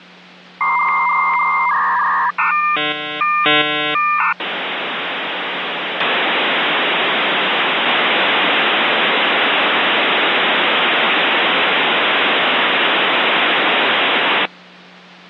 Dial-up modem handshake (V.34 or later), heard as a whistle, warbles, then hiss, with hum.